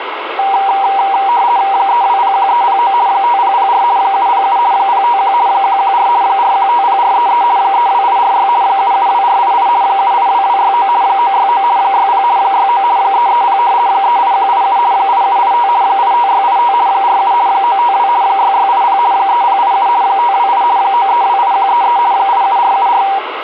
RTTY (50 baud, 170 Hz shift), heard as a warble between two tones, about 870 Hz centre, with radio static. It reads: 3201309 5004 707 051 114 4150433 32846 772488 782269 969 60 69 330 38187 8785 85685 47 952 6680 3087 528 9328133 87474